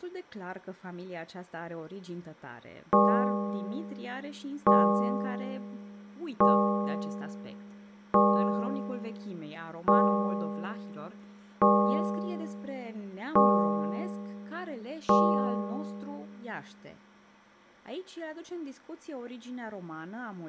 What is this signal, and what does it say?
Clock strike, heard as a bell, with speech in Romanian. 8. Eight o'clock.